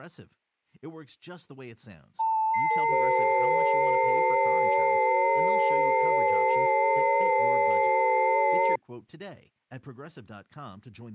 FT8 (several signals at once), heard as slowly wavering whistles, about 6.25 baud, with speech in English.